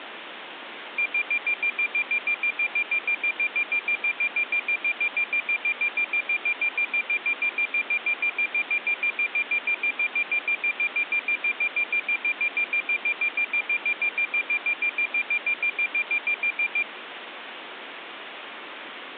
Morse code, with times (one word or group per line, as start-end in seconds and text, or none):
none